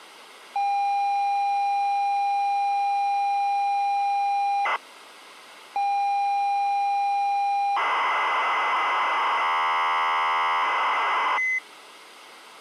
ZX Spectrum tape loading, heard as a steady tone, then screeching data.